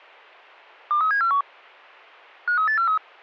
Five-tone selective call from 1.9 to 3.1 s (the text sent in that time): 53843